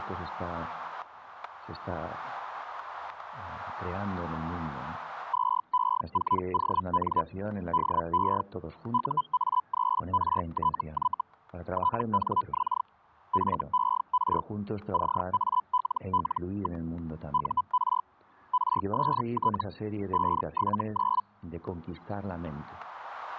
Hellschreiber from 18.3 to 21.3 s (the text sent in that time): RST 579